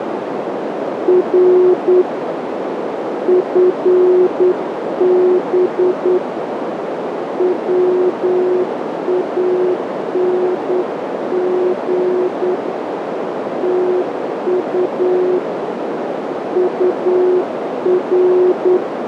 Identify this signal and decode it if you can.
Morse code, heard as a keyed tone, hand-sent with a straight key, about 9 wpm, 360 Hz, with heavy radio static and a narrow filter. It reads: R FB WANG TU UR